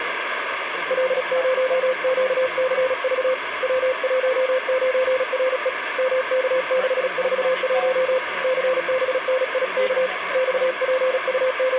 Morse code, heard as a keyed tone, hand-sent with a paddle, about 36 wpm, 520 Hz, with radio static. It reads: L0QCV W19RE MK641 CBNIK …